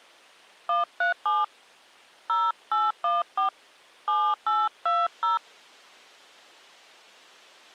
DTMF, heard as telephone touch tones, dialled by hand, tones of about 180 ms. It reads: 137 0814 7820